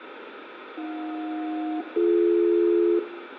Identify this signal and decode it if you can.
Aircraft SELCAL, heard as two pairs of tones, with radio static, fading and room echo. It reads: AJ-BD